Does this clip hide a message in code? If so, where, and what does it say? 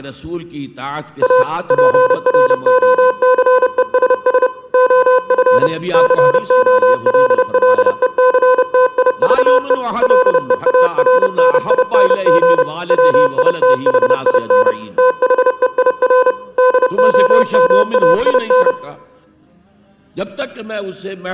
Yes: Morse code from 1.2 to 18.8 s, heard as electronic beeps, machine-sent, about 30 wpm, 510 Hz. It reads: A PROCESS OF COLLECTIVE LEARNING WITHIN THEIR DOMAIN